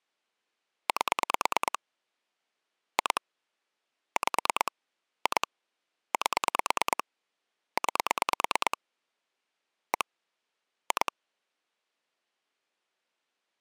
Pulse dialling, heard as clicks on a phone line, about 9 pulses a second. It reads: 8 2 5 2 8 9 1 2